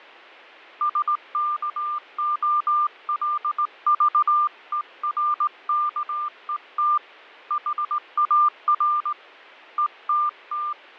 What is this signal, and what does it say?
Morse code, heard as a keyed tone, hand-sent with a straight key, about 18 wpm, 1200 Hz, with fading. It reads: SKOLVERKET HAR ETT